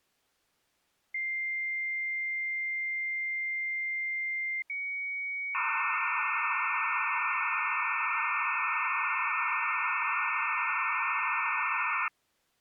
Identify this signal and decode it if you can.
Dial-up modem handshake (low-speed, two carriers), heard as two whistles, then hiss.